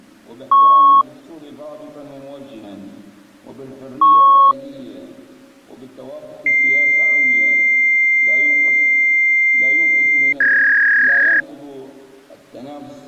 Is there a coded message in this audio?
Yes: fax machine handshake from 0.5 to 11.4 s, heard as beeps, a long tone and a warble.